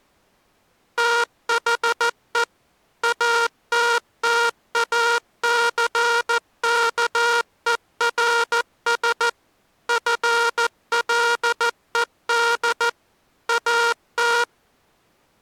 Morse code, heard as a buzzer, machine-sent, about 14 wpm. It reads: THE ATTACKERS FLED AT